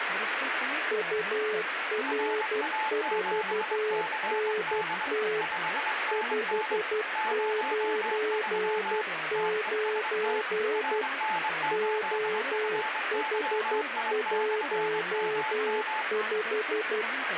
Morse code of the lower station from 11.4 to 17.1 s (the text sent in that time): OH15